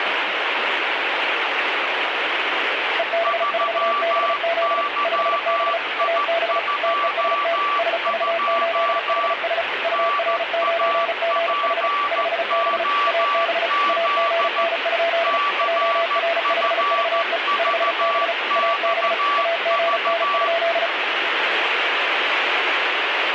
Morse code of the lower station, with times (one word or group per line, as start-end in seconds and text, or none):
3.0-4.8 EB4BZ
5.0-5.8 5B
6.0-6.6 AB
6.8-7.6 TEST
7.8-9.6 SV8HS
9.8-11.9 UR9GH
12.1-12.8 5B
13.1-13.7 AB
13.9-15.4 AGN?
15.6-17.4 JR5VE
17.6-18.3 5B
18.6-19.1 AB
19.4-20.9 AGN?